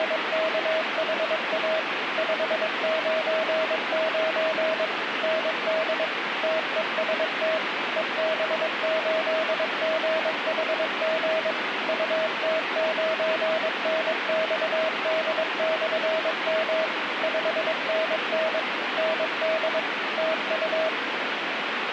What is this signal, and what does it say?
Morse code, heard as a keyed tone, machine-sent, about 22 wpm, 640 Hz, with radio static. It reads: … 599 ND TEST EB8GHG UT9NXD/M 5NN ND TU